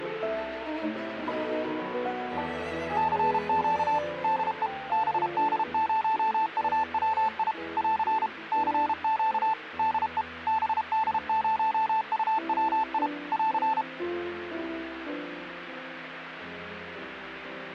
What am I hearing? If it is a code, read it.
Morse code, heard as a keyed tone, machine-sent, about 32 wpm, 880 Hz. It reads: CQ DE BD0UWI <AR> CQ DE BD0UWI <AR>